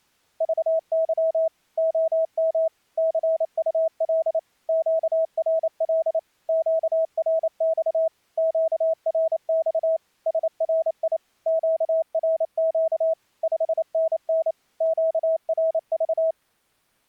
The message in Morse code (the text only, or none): VY OM CUL QRL QRX QRX SRI QRQ 5NN QRV